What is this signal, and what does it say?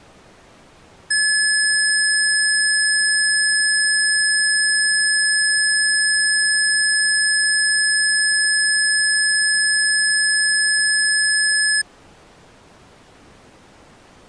A steady tone. There is no code.